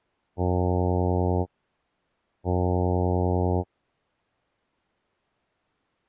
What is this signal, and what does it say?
Ship horn signal, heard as a ship's horn, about 90 Hz. 2 short. At sea: I am altering course to port.